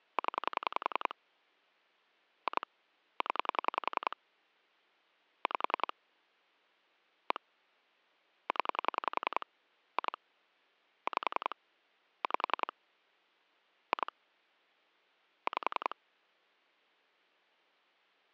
Pulse dialling, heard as clicks on a phone line, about 10 pulses a second. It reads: 0 2 0 5 1 0 2 5 5 2 5